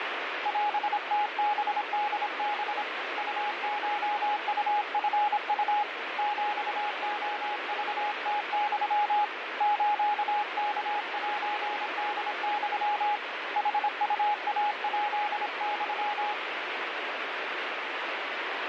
Morse code (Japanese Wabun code), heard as a keyed tone, hand-sent with a paddle, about 26 wpm, 830 Hz, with radio static. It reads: オムハホハ ウコウチウ ヒレクムユ スワセホユ ヌウイヱユ